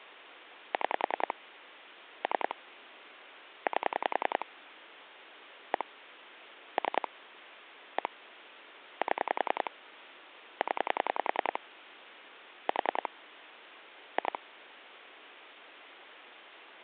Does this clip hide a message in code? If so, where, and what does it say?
Yes: pulse dialling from 0.7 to 14.4 s, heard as clicks on a phone line, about 10 pulses a second, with phone line noise. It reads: 6 3 8 1 3 1 7 0 4 2